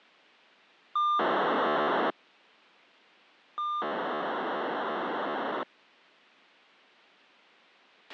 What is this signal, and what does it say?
POCSAG pager data (2400 baud), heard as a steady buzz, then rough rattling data, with a squelch burst at the end.